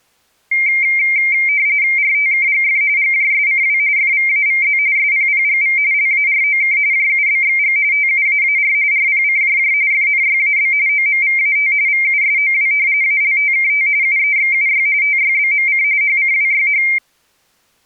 RTTY (45.45 baud, 170 Hz shift), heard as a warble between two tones, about 2200 Hz centre. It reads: RTKGF GJSCW FVAVZ SPPGV LAROK JUBXG TUAAR RPCJJ FNYAB OMVAT VUSOW ALTKT UEXUY TYBMC HCWYH